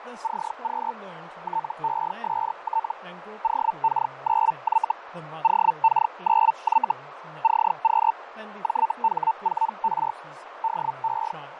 Hellschreiber (Feld-Hell, 122.5 baud), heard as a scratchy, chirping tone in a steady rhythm, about 900 Hz, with radio static, fading, a narrow filter and speech in English. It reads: CQ TEST OK9Y OK9Y CQ JH4R DE